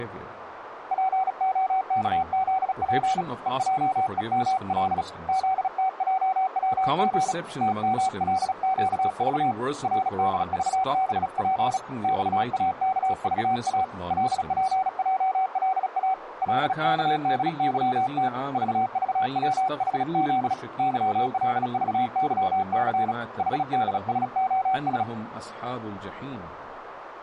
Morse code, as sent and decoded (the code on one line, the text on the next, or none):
.--. --- -.- --.. .--. / . .--- . -- .-.. / --.. - .--- .-- --. / - -- .-.. --.- ...- / .-. -.. ...- -... .--. / -..- .- -.- ...- .- / .-.. .--. .--- .-.. .- / .-.. -.- -.. -.-- - / ...- ...- .-- .... --.. / -.-- .-.. ...- -.-- -.-. / .... -.. ... --- ...
POKZP EJEML ZTJWG TMLQV RDVBP XAKVA LPJLA LKDYT VVWHZ YLVYC HDSOS